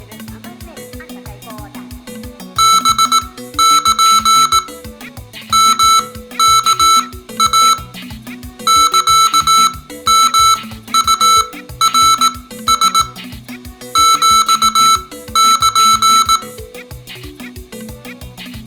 Morse code (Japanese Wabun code), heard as electronic beeps, machine-sent, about 18 wpm, spaced as for 13 wpm, 1320 Hz. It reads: ハル ヨワイ サヨウナラ ヒル